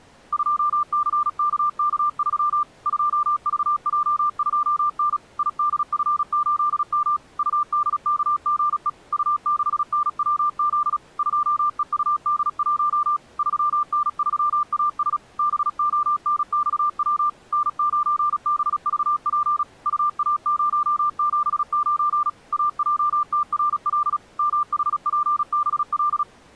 Morse code, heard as a keyed tone, machine-sent, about 36 wpm, 1190 Hz. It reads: 2CKK3 2VJ2N IDF8M UDKGE U6NWZ 2EUD1 3N3AS BONXW N9BVP UA079 AJTRL MHPBL